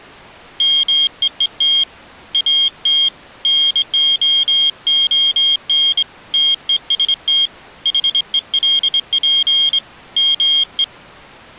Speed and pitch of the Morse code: 24 wpm, 3250 Hz

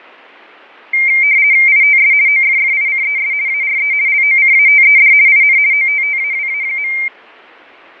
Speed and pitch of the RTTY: 50 baud, 170 Hz shift, 2200 Hz centre

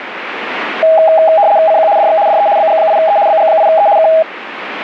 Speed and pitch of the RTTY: 75 baud, 170 Hz shift, 730 Hz centre

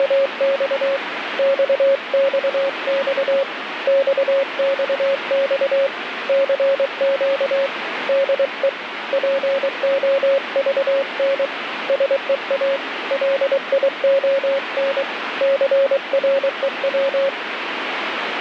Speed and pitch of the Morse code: 23 wpm, 550 Hz

